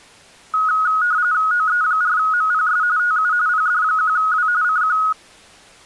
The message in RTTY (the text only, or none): OE4MPS TU PD1W CQ